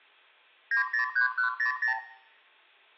Multi-frequency trunk signalling (R2, with the far end's replies), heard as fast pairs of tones, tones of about 110 ms, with room echo. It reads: 903100